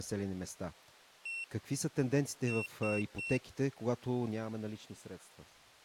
Beep code, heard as a piezo beeper, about 2700 Hz, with speech in Bulgarian. 1-3.